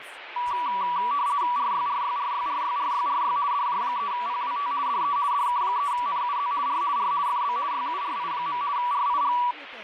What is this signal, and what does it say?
RTTY (50 baud, 170 Hz shift), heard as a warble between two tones, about 1060 Hz centre, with radio static and speech in English. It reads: RYRYRYRYRYRY DJ3PWT DE DK3NUZ R R FB YURI. RIG